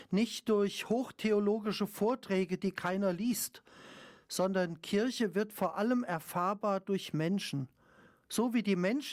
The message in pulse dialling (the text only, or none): none